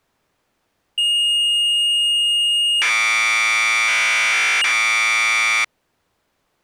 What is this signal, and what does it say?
Commodore tape loading (standard loader), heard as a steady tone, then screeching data.